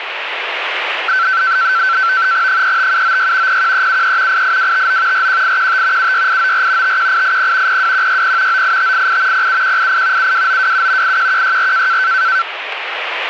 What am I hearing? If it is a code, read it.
NAVTEX (SITOR-B), 100 baud, 170 Hz shift, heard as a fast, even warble, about 1440 Hz centre, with radio static. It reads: 35796 01373 88259 41815 76894 51880 02160 98588 07188 72927 81164